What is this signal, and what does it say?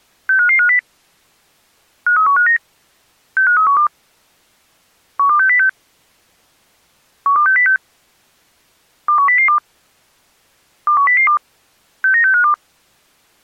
Five-tone selective call (CCIR), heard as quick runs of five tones, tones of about 100 ms. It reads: 65550 53159 65312 12606 12606 21002 21002 69652